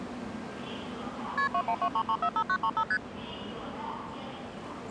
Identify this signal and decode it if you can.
Multi-frequency trunk signalling (R1, as on North American trunks), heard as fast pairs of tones, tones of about 70 ms, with the noise of a subway station. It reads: KP 2123345935 ST